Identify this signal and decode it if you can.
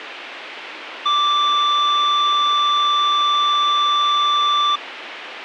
A steady tone. There is no code.